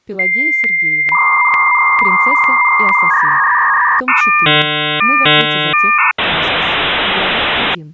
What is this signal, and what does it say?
Dial-up modem handshake (V.34 or later), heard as a whistle, warbles, then hiss.